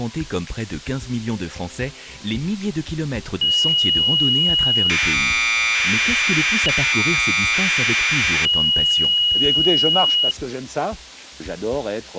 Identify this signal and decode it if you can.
Commodore tape loading (standard loader), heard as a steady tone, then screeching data.